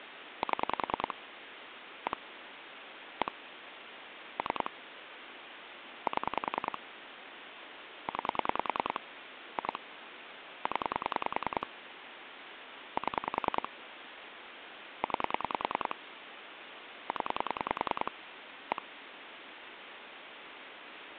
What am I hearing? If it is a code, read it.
Pulse dialling, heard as clicks on a phone line, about 10 pulses a second, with phone line noise. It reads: 7 1 1 3 7 9 2 0 7 9 0 1